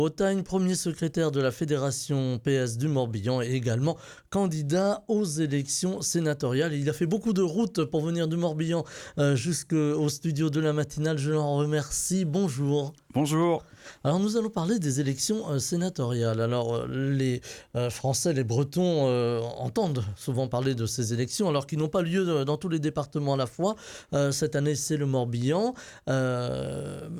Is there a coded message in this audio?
No.